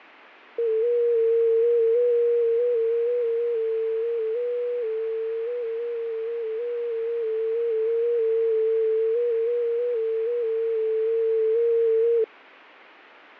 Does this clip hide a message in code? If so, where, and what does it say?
Yes: FT8 (one signal) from 0.6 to 12.2 s, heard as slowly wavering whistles, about 6.25 baud, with fading.